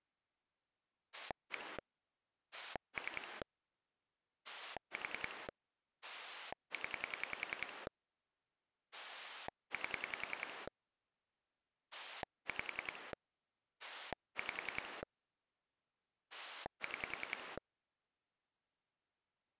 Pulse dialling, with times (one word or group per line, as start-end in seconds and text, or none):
1.1-1.8 1
2.5-3.4 3
4.4-5.5 4
6.0-7.9 0
8.9-10.7 8
11.9-13.1 5
13.8-15.0 5
16.3-17.6 6